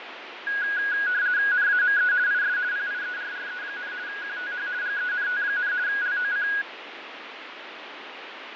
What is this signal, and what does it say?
RTTY (50 baud, 170 Hz shift), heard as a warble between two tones, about 1550 Hz centre, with radio static and fading. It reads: NAME IS PIERRE, QTH GENT, LOC